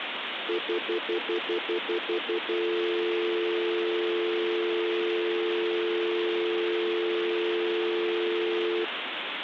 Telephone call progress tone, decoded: stutter dial tone

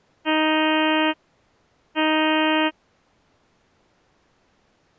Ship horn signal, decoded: 2 short

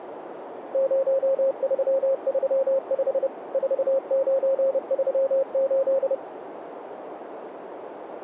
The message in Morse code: 0335 4938

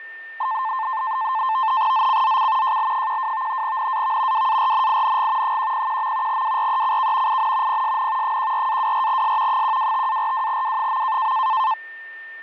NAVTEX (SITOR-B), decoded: ZCZC JL12 NAV WARNING 101. WRECK IN PSN 14-24S 125-42W.

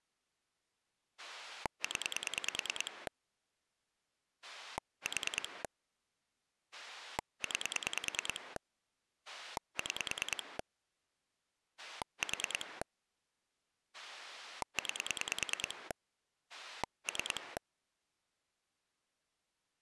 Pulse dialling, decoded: 0 4 9 6 4 9 3

